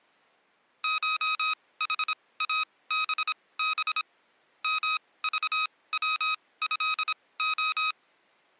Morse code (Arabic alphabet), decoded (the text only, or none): شحابب مضوهخ